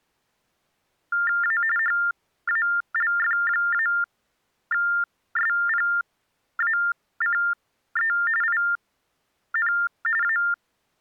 TTY/TDD text telephone tones (45.45 baud Baudot), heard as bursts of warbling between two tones, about 400 Hz shift, 1600 Hz centre. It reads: A HALF-SPACE IN A